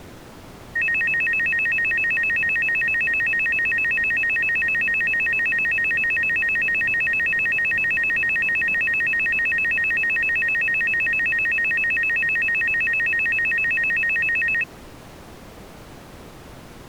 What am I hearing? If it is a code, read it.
A tone that alternates evenly between two pitches. There is no code.